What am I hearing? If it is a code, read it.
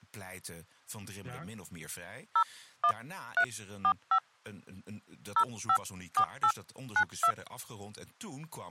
DTMF, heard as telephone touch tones, dialled by hand, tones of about 70 ms, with speech in Dutch. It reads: 01345 054892